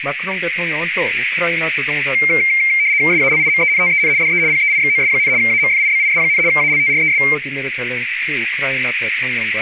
RTTY (75 baud, 170 Hz shift), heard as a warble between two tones, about 2200 Hz centre, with radio static and a narrow filter. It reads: SALIMENTEN DE PEIXOS, AMFIBIS, ALTRES